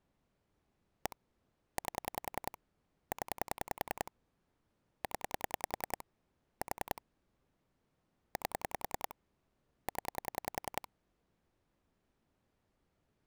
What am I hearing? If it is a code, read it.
Pulse dialling, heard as clicks on a phone line, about 10 pulses a second. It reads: 1 8 0 0 4 8 0